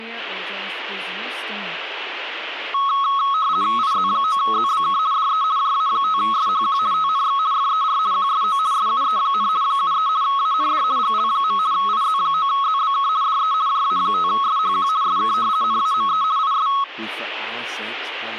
RTTY (50 baud, 170 Hz shift), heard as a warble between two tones, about 1190 Hz centre, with speech in English. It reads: IZ9ZBK DE JA5SHQ TNX FER QSO SUE, 73 AND GL. IZ9ZBK DE JA5SHQ SK NAME IS